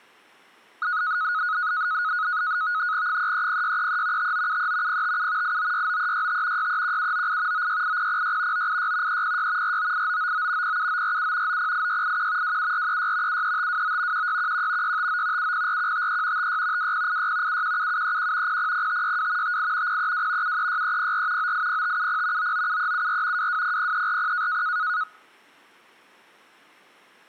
NAVTEX (SITOR-B), 100 baud, 170 Hz shift, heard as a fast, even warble, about 1360 Hz centre. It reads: 330633 5973 057 8969365 631798 968006 986 306 498999 07947 908681 27436 73529 1611 659 704153 56 2086 717731 000562 58 032 736304 980570 997374 2200340